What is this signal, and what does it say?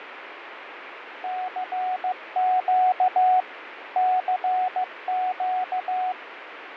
Morse code, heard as a keyed tone, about 15 wpm, 740 Hz, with radio static and fading. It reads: CQ CQ